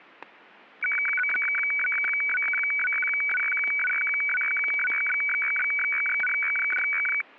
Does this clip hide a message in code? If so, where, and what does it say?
Yes: weather fax (radiofax), 120 lines a minute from 0.8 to 7.2 s, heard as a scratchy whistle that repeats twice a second, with static crashes.